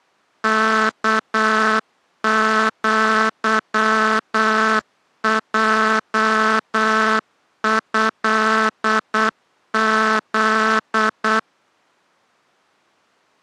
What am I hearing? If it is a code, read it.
Morse code (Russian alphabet), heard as a buzzer, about 8 wpm. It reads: КЪЙЭЗ